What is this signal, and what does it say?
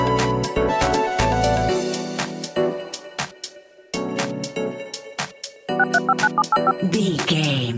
DTMF, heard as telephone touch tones, dialled by machine, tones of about 40 ms. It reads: 6359785